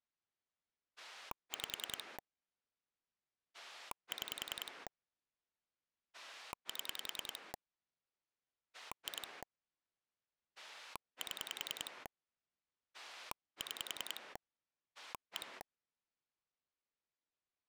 Pulse dialling, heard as a rotary dial, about 10 pulses a second. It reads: 5 6 7 2 7 6 1